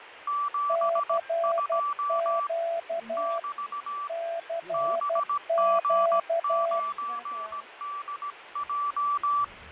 Morse code, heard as two keyed tones, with radio static, fading and the noise inside a car. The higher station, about 17 wpm, 1160 Hz: 72 <BT> BG9DJ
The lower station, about 12 wpm, 670 Hz: CQ CQ